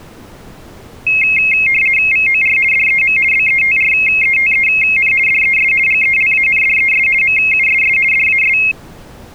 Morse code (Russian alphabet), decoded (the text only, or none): none